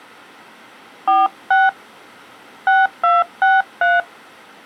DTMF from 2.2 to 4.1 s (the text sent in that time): 6263